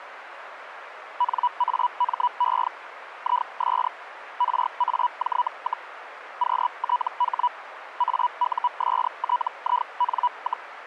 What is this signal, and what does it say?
Hellschreiber (Feld-Hell, 122.5 baud), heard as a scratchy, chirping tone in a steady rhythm, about 980 Hz, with radio static. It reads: NAME IS RAJ, QTH AUSTIN,